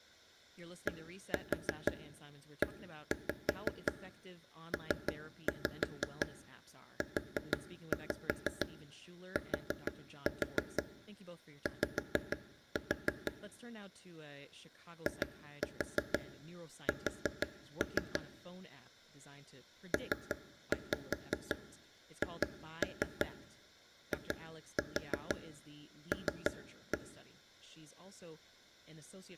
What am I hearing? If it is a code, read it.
Tap code, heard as taps on a table, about 6 knocks a second, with speech in English. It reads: DEPUTY IS PHIL